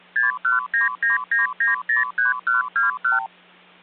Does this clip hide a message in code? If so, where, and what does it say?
Yes: multi-frequency trunk signalling (R2, with the far end's replies) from 0.2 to 3.3 s, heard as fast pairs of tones, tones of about 140 ms, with hum. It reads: 61999903121